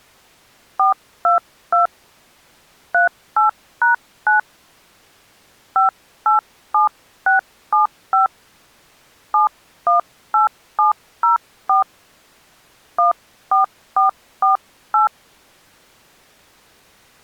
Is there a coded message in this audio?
Yes: DTMF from 0.8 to 15.1 s, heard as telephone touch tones, dialled by hand, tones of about 130 ms. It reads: 422 38#9 587675 718704 14448